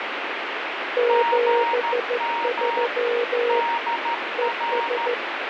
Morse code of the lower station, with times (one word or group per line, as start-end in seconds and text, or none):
1.0-3.6 73
4.4-5.1 ES